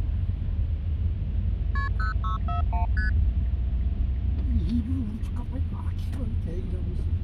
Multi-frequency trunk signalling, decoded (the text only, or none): KP 0641 ST